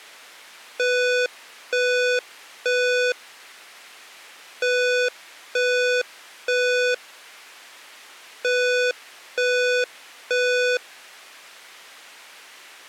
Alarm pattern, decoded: temporal three

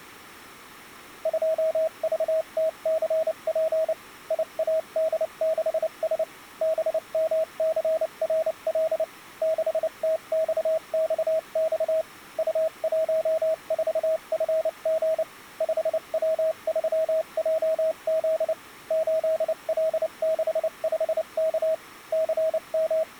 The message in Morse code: 2VTCP IAD6S BMCRL 6TXXX U14FG 5W3JZ 8L65K …

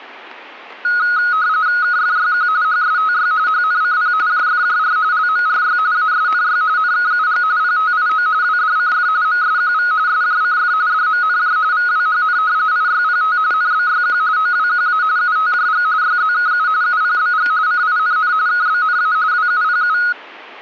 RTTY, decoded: KFYQ HSTY HNCP JFJR LMRY ASNY NKUG PTIO WDCF MSQV SJCF DMNJ VWHN IYPT NBYQ OWQA UTJG YZKU UPBG CINN KBNA WUPU

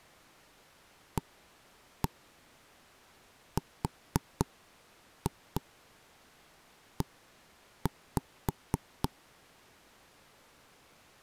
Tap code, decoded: ARE

